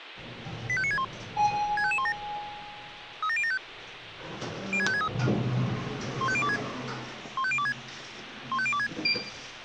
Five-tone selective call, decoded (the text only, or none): 85961 65517 37075 06563 15026 15026 15026